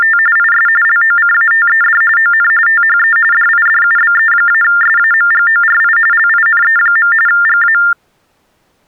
TTY/TDD text telephone tones (45.45 baud Baudot), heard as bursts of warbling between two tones, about 400 Hz shift, 1600 Hz centre. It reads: … IS LOCATED ON THE DIDUBE-SAMGORI LINE. GA